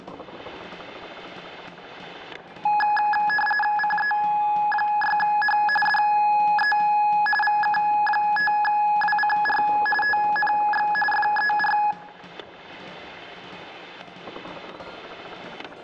RTTY (45.45 baud, 850 Hz shift), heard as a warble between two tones, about 1260 Hz centre, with static crashes and room echo. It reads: CE6H DE VK5WCR TNX FER